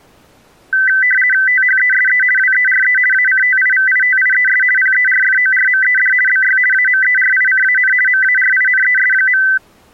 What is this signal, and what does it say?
RTTY (50 baud, 450 Hz shift), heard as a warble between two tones, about 1750 Hz centre. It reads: THESE WERE ACTIVITIES PERFORMED BY AMERICAN MARINES.